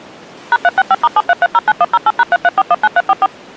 DTMF, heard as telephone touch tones, dialled by machine, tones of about 40 ms. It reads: #365*73309108#33419344